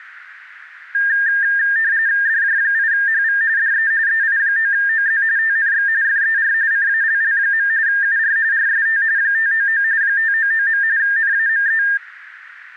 RTTY (45.45 baud, 170 Hz shift), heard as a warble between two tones, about 1700 Hz centre, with radio static. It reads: DJ8HV DE EI9OZ TNX FER CALL. UR RST 599 599. NAME